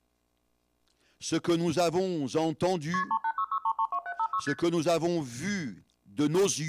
Multi-frequency trunk signalling (R1, as on North American trunks), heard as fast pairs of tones, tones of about 70 ms. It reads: KP 3866332756 ST